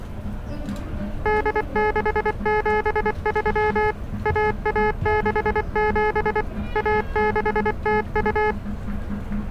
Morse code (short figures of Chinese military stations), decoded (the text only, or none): 8673 1167 1602